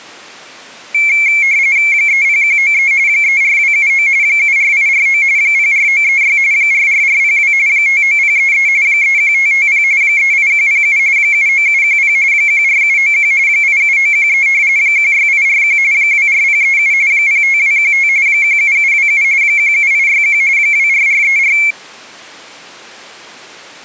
RTTY (45.45 baud, 170 Hz shift), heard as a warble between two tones, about 2250 Hz centre. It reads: 30193 34279 74849 04936 44402 59033 31550 38107 79710 14791 87913 16841 24037 05215 17727 17861 24434